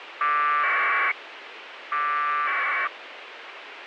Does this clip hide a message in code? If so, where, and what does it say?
Yes: packet radio (AX.25, as in APRS), 1200 baud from 0.2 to 2.9 s, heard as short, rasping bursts, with radio hiss.